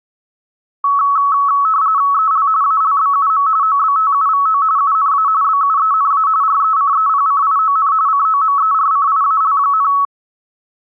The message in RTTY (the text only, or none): EL ALBUM OBTUVO UNA BUENA RECEPCION COMERCIAL,